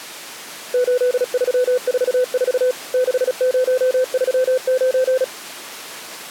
Morse code, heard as a keyed tone, machine-sent, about 36 wpm, 510 Hz. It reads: 8344 6039